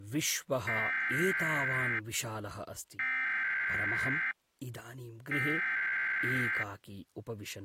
Emergency Alert System (SAME) tones (header bursts), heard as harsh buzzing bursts, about 520.83 baud, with speech in Sanskrit.